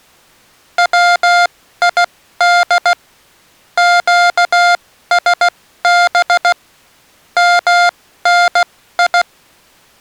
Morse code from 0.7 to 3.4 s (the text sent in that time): WID